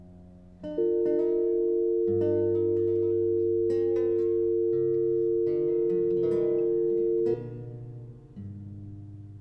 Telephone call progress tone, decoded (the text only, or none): dial tone